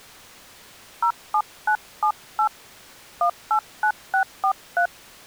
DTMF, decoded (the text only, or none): 07978 189643